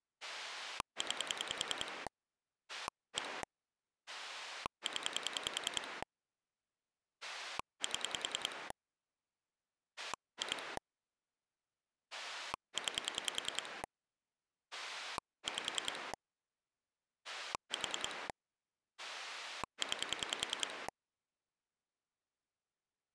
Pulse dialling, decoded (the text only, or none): 9 1 0 7 2 9 5 4 9